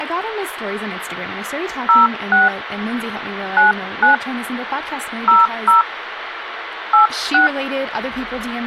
DTMF, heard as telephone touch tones, dialled by hand, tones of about 130 ms, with phone line noise and speech in English. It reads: 06 99 00 86